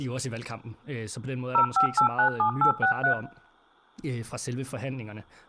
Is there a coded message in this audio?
Yes: DTMF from 1.5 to 3.1 s, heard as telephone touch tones, dialled by machine, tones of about 100 ms, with room echo and speech in Danish. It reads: 05897863